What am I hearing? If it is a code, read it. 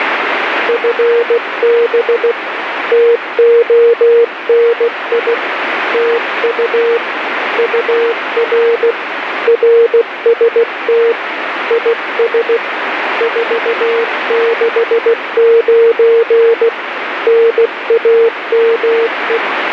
Morse code, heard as a keyed tone, hand-sent with a paddle, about 16 wpm, 460 Hz, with radio static. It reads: FB TONI TU UR RST IS 469 NAME